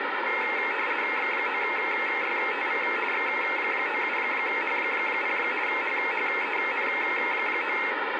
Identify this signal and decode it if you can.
RTTY (50 baud, 450 Hz shift), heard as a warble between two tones, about 2350 Hz centre, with radio static and a steady whistle near 1610 Hz. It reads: X9YTV X97H0 HHEN9